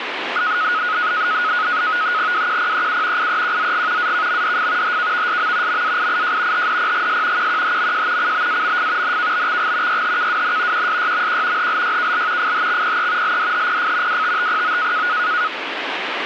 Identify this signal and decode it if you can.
NAVTEX (SITOR-B), 100 baud, 170 Hz shift, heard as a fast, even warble, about 1360 Hz centre, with radio static. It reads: WQPEU IEQZG AKMDF HKVSM MAIIJ HDPGS QQHMJ CBAMF NKBXG YHKWN QSYMQ HLYKL FHXPE LDHPF WTTPO